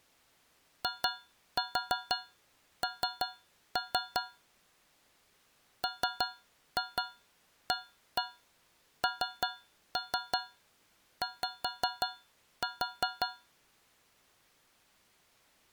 Tap code, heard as taps on a metal pipe, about 5 knocks a second. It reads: IN MANY